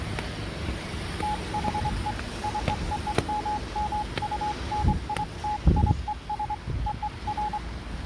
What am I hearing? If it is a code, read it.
Morse code (American railroad code), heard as a keyed tone, hand-sent with a straight key, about 840 Hz, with the noise of a residential street. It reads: THE COMMUNITIES OF